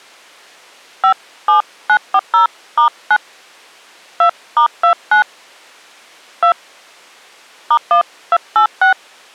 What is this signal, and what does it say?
DTMF, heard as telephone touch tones, dialled by hand, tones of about 80 ms. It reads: 57940*9 2*29 2 *1286